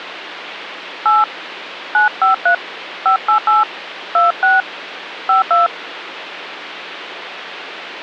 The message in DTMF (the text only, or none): 8 953 588 26 52